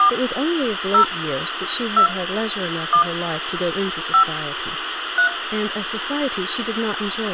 DTMF, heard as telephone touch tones, dialled by hand, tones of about 100 ms, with phone line noise and speech in English. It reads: 4 0 2 1 5 3